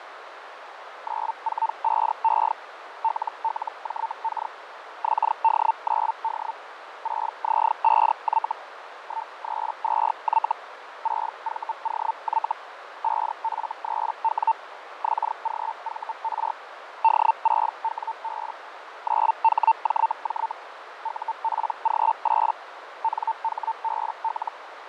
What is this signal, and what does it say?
Hellschreiber (Feld-Hell, 122.5 baud), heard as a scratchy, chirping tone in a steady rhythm, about 900 Hz, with radio static, fading and a narrow filter. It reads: 945E LLJK XD9D 6Z5Y 132Y 6VOY 5F3W XGVR D6WB 9HJJ UPG8 NHBL